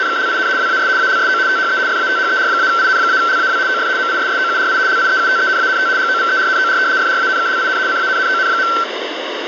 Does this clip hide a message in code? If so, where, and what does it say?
Yes: RTTY (75 baud, 170 Hz shift) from 0.0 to 8.8 s, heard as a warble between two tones, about 1440 Hz centre, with radio static. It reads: … WAS ALSO THE FATHER-IN-LAW OF MISSOURI LIEUTENANT GOVERNOR FRANKLIN CANNON.